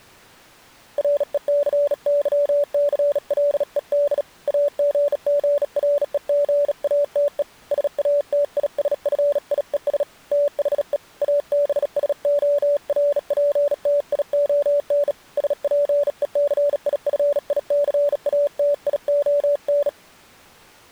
Morse code, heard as a keyed tone, hand-sent with a bug key, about 37 wpm, 580 Hz. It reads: RECYCLED AGGREGATE SATISFIES THE ABSORPTION SPECIFICATION